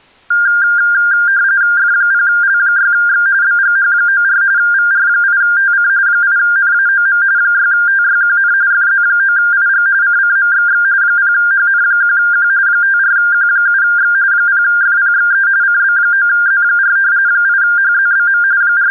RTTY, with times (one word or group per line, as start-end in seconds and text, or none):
1.8-3.3 F0L6X
3.4-4.4 BGH94
4.6-5.9 VR8TC
6.1-7.2 8NAOM
7.4-8.5 6TYQN
8.7-9.9 FZ9IG
10.0-10.8 CCMXX
11.0-12.5 0HN1Q
12.7-14.1 54Q7X
14.3-15.5 0FPXE
15.6-17.0 CB9Z4
17.3-18.4 8HZBM
18.6-18.9 …